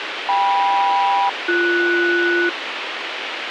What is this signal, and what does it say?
Aircraft SELCAL, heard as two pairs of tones, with radio hiss. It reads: KM-BS